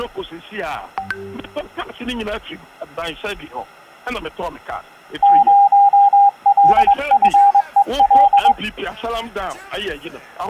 Morse code, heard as a keyed tone, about 22 wpm, 800 Hz. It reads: 0LFEL